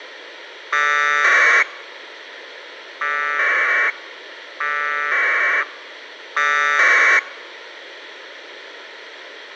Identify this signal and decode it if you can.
Packet radio (AX.25, as in APRS), 1200 baud, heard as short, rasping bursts, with radio hiss.